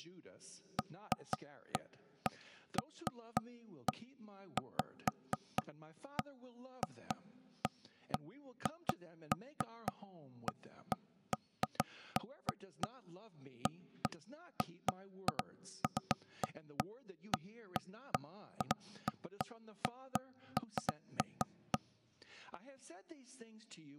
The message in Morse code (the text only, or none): none